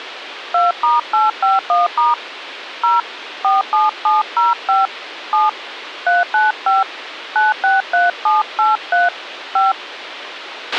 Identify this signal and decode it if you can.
DTMF, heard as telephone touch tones, dialled by hand, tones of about 170 ms, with radio hiss and a squelch burst at the end. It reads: 2*851* 0 47705 7 395 963783 5